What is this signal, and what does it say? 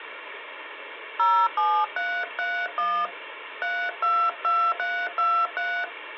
DTMF, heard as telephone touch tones, dialled by hand, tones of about 270 ms, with phone line noise. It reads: 07331 322323